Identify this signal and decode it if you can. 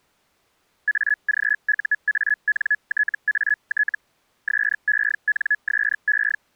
Hellschreiber (Feld-Hell, 122.5 baud), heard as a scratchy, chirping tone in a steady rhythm, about 1700 Hz. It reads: AGUANTAT SENSE